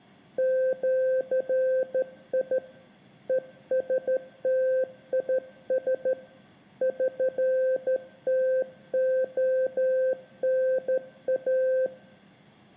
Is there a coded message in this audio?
Yes: Morse code (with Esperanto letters) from 0.3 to 11.9 s, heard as a keyed tone, hand-sent with a straight key, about 13 wpm, 520 Hz, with room echo. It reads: ĜI ESTIS ŜTONA